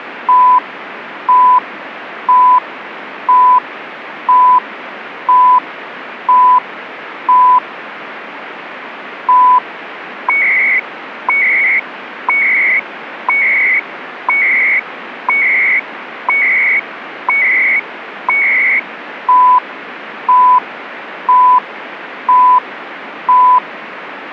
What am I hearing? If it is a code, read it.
Radio time signal (CHU, Canada), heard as beeps and data bursts, one a second, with radio static.